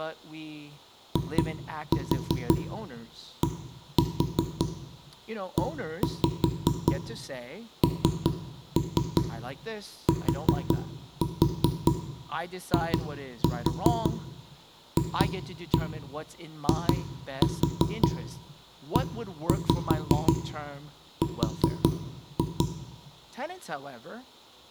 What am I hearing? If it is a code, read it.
Tap code, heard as knocks on wood, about 5 knocks a second, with room echo and speech in English. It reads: IDENTIFIER